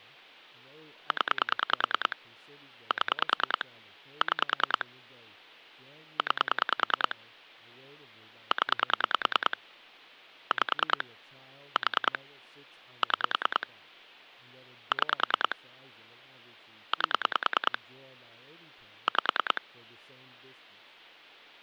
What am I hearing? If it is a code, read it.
Pulse dialling, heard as clicks on a phone line, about 10 pulses a second, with speech in English. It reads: 0 7 6 9 0 5 4 6 6 8 5